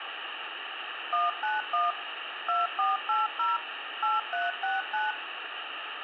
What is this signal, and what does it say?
DTMF, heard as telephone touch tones, dialled by machine, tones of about 170 ms, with phone line noise. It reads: 191 2480 8369